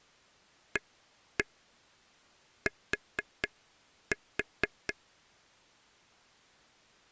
Tap code, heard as taps on a table, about 4 knocks a second. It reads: AT